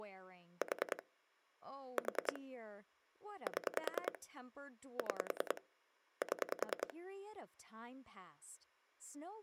Pulse dialling, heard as clicks on a phone line, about 10 pulses a second, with speech in English. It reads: 4 4 7 6 7